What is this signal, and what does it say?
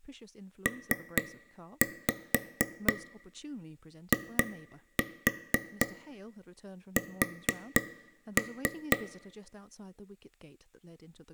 Tap code, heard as taps on a table, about 4 knocks a second, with room echo and speech in English. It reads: PIS